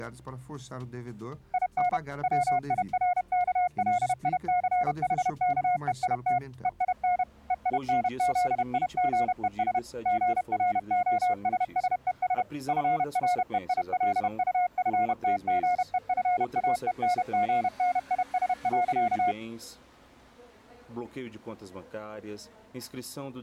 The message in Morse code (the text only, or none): IN WIRKLICHKEIT EIN EINZIGES GROSSES FREILUFTGEFAENGNIS.